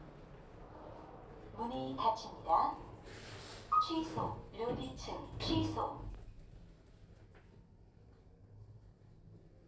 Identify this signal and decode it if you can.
The noise inside a lift. There is no code.